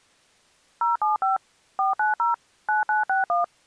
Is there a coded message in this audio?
Yes: DTMF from 0.8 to 3.4 s, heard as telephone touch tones, dialled by machine, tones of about 140 ms. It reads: 075 490 9961